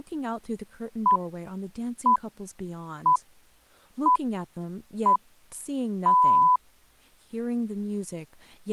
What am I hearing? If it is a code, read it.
Radio time signal (six pips, as the Greenwich Time Signal), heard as pips, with speech in English.